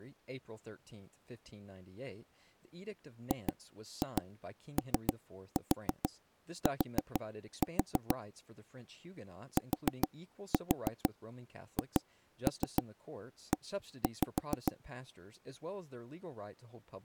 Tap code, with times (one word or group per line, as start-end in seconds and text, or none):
3.3-8.2 GOT
9.6-14.7 THE